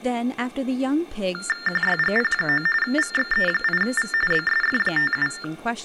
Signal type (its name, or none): TTY/TDD text telephone tones